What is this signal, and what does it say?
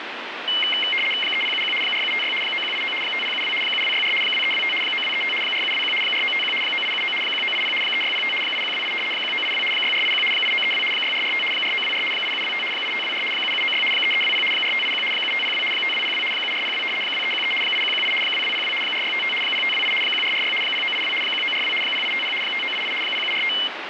RTTY (75 baud, 850 Hz shift), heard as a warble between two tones, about 2550 Hz centre, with radio static. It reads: 3071 4756 9189 5072 7264 2325 9235 4721 4951 9879 1980 3605 8128 1982 6481 8932 6445 4924 8725 8524 7796 3320 4581 7502 5202 7402 2313 8118 2202 4655 0528 1446 0982 1942 0850 5988 0745